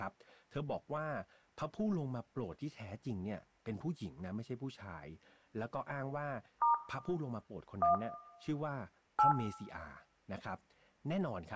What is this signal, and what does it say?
DTMF, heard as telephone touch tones, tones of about 130 ms, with room echo and speech in Thai. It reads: * 1 8